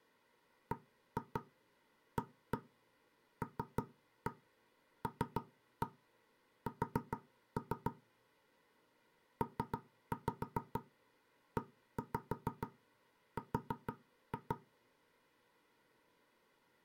Tap code, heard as knocks on wood, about 6 knocks a second. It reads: BALLS PER